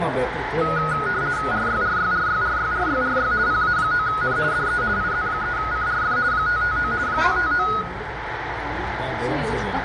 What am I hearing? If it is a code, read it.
RTTY (50 baud, 170 Hz shift), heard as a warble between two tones, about 1360 Hz centre, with radio static, room echo and the noise of a restaurant. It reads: RYRYRYRYRYRY PA9N DE IZ3CRF 559 559